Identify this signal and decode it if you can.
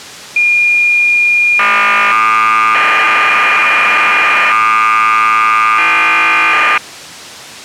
Cassette data (Kansas City type), 1200 baud, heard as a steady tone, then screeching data.